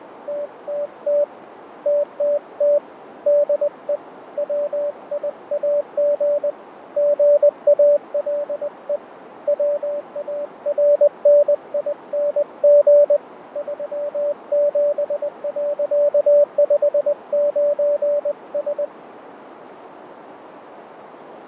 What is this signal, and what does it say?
Morse code, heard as a keyed tone, hand-sent with a paddle, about 20 wpm, 580 Hz, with radio static, fading and a narrow filter. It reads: TTT TTT DE WIAG GALE WARNING 37.59S